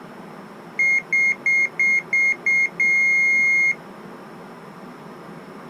Beep code, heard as a piezo beeper, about 2150 Hz. 6 short, 1 long.